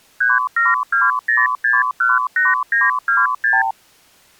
Multi-frequency trunk signalling (R2, with the far end's replies), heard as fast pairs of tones, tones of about 180 ms. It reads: 3720618926